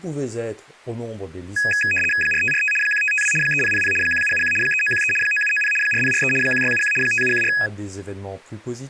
RTTY (75 baud, 850 Hz shift), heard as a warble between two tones, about 2100 Hz centre, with speech in French. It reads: 4545 1552 3000 1771 3913 9790 4043 1671 5714